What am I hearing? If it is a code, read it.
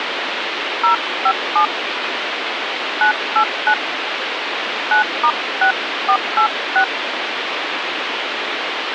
DTMF, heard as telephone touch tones, dialled by hand, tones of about 90 ms, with phone line noise. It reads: 057 989 9*6486